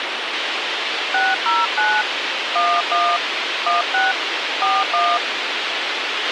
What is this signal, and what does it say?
DTMF, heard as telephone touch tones, dialled by hand, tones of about 200 ms, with radio hiss and a squelch burst at the end. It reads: 609 11 16 41